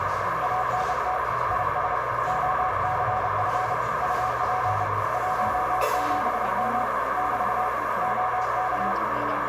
Morse code, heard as a keyed tone, hand-sent with a paddle, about 30 wpm, 740 Hz, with heavy radio static, a narrow filter and the noise of a cafe. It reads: ANT IS OCF UP 17M <BT> OK